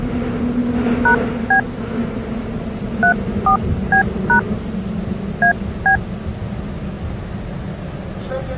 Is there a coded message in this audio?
Yes: DTMF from 1.1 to 6.0 s, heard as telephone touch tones, dialled by hand, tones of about 100 ms, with the noise inside a subway train. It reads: #B 34B# AB